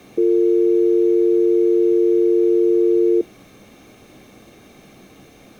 Telephone call progress tone (North American or UK plan), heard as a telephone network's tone, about 350, 450 Hz. Dial tone.